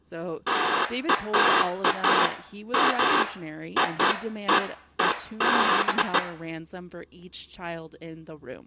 Bursts of noise, with room echo and speech in English. There is no code.